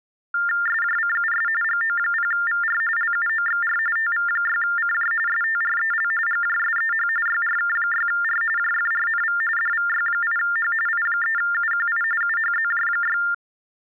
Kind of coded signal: TTY/TDD text telephone tones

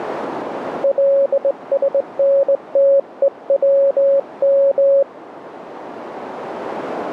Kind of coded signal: Morse code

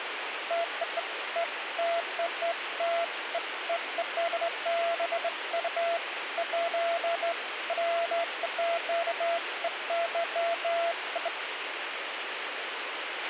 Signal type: none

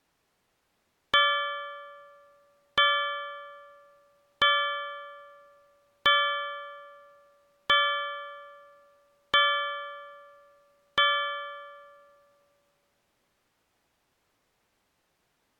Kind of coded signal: clock strike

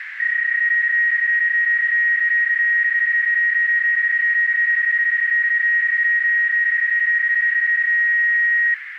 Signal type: PSK31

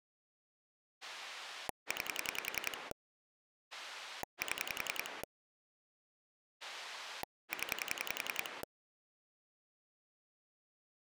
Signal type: pulse dialling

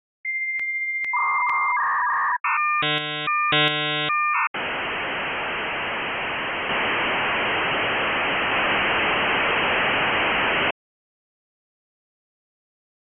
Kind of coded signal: dial-up modem handshake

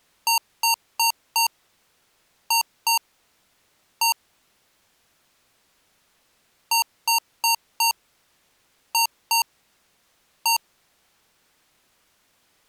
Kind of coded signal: beep code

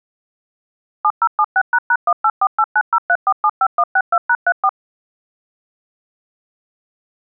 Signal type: DTMF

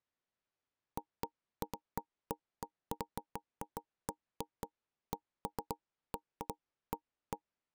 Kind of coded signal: none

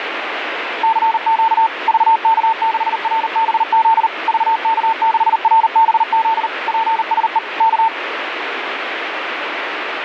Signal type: Morse code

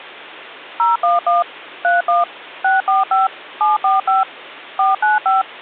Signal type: DTMF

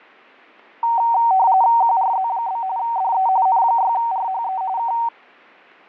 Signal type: RTTY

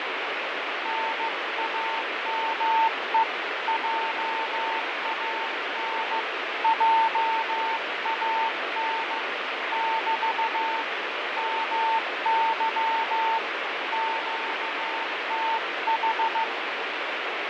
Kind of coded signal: Morse code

